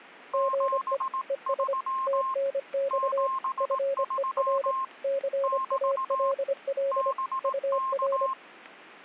Morse code, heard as two keyed tones. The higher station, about 18 wpm, 1060 Hz: 73 73 <BT> BK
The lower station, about 25 wpm, 550 Hz: GE ES TNX FER CALL UR